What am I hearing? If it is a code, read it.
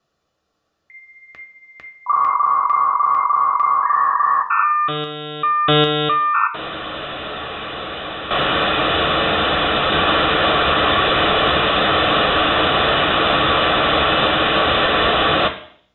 Dial-up modem handshake (V.34 or later), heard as a whistle, warbles, then hiss, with room echo.